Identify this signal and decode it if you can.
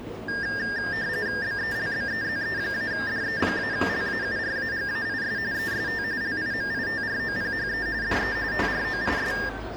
RTTY (45.45 baud, 170 Hz shift), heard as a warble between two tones, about 1700 Hz centre, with the noise of a cafe. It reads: BELBEZE-DE-LAURAGAIS EST LIMITROPHE DE TROIS